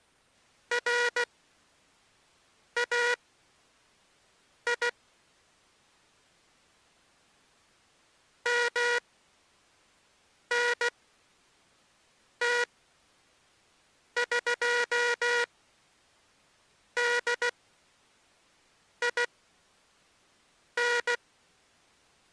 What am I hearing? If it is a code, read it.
Morse code (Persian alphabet), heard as a buzzer, machine-sent, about 16 wpm, spaced as for 5 wpm. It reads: رای منتقدین